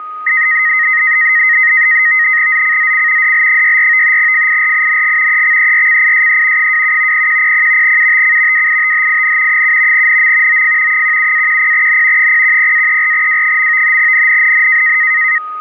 NAVTEX (SITOR-B), 100 baud, 170 Hz shift, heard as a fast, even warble, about 1950 Hz centre, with a steady whistle near 1250 Hz. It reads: ZCZC DL64 FIRING EXERCISE 27 0100 UTC WITHIN 7 NM OF 17-10N 010-34W. NNNN